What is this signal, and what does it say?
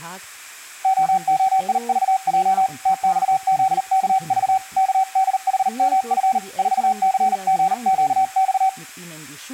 Morse code, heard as a keyed tone, hand-sent with a paddle, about 39 wpm, 760 Hz, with speech in German. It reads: OOIVJ TXZKV KDHMF 4CGQX